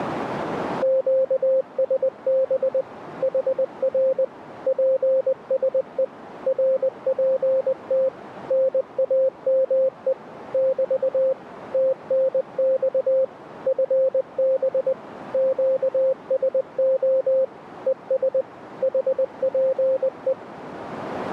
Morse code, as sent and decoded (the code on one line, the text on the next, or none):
--.- ... -... / .... .-. / .--. ... . / .-. .--. - / -. .- -- . / -...- / - -. -..- / ..-. -... / --.- ... --- / . ... / .... .--. .
QSB HR PSE RPT NAME <BT> TNX FB QSO ES HPE